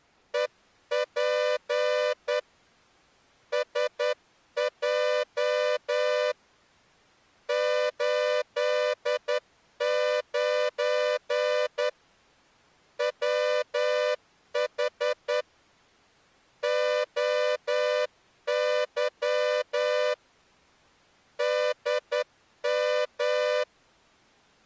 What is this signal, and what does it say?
Morse code, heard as a horn, hand-sent with a straight key, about 10 wpm. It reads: EP SJ 89 WH OY DM